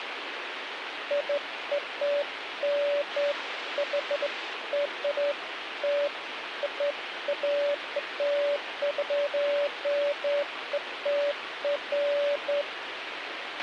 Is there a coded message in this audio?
No, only beeps of irregular length, with radio hiss and a squelch burst at the end.